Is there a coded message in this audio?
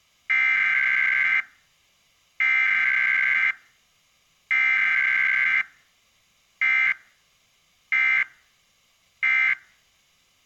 Yes: Emergency Alert System (SAME) tones (header bursts, then end-of-message bursts) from 0.3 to 9.5 s, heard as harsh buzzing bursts, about 520.83 baud.